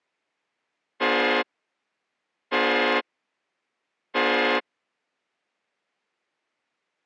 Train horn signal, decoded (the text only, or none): 3 short